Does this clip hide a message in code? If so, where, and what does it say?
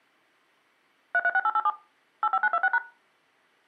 Yes: DTMF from 1.1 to 2.8 s, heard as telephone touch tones, dialled by machine, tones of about 50 ms. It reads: 336887 85926#